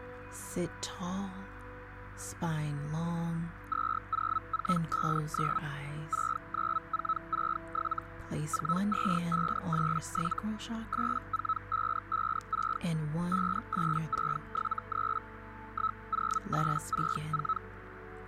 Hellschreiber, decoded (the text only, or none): 20459 69467 42587 84556 58673 10864